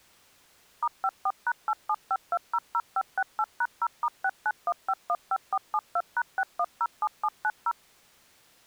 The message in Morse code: none

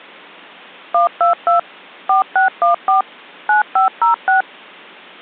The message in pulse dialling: none

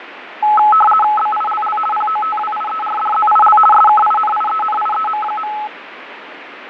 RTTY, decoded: BILL POTWIERDZIL SKINIENIEM.

